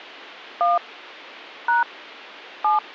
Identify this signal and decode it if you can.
DTMF, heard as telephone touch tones, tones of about 150 ms. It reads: 1 # 7